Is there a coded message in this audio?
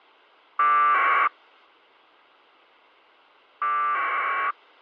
Yes: packet radio (AX.25, as in APRS), 1200 baud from 0.6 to 4.5 s, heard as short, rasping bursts.